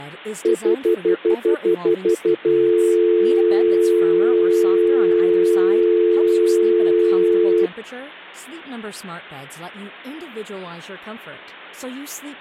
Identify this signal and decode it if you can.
Telephone call progress tone (North American plan), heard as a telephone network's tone, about 350, 440 Hz, 0.1 s on and 0.1 s off, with speech in Swedish. Stutter dial tone.